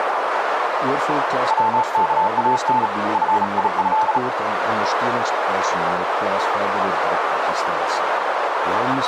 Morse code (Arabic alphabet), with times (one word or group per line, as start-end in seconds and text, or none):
1.5-2.9 وكان
3.1-4.2 فيه